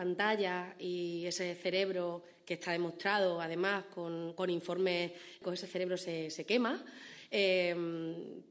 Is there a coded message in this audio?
No.